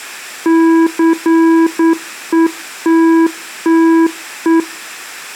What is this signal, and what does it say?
Morse code, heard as a keyed tone, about 9 wpm, 330 Hz. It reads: CETTE